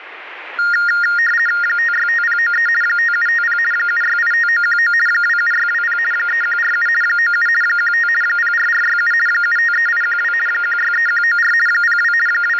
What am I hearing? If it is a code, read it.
RTTY (50 baud, 450 Hz shift), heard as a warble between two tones, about 1650 Hz centre, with radio static. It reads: 565093 5750 7685919 27620 3147 97 15 04467 753812 163194 02 …